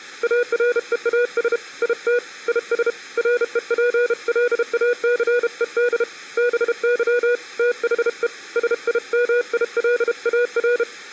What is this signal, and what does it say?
Morse code, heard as a keyed tone, hand-sent with a paddle, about 32 wpm, 490 Hz. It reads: AREAS IT IS REPLACED BY THE SIMILAR